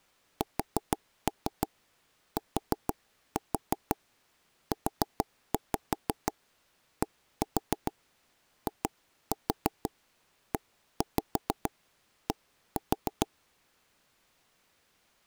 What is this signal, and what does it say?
Tap code, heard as knocks on wood, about 6 knocks a second. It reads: STUDIED